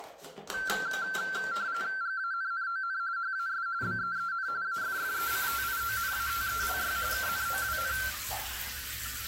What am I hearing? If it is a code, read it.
RTTY (45.45 baud, 170 Hz shift), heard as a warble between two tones, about 1460 Hz centre, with the noise of a restroom. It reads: GANNON HAS BEEN AFFECTIONATELY KNOWN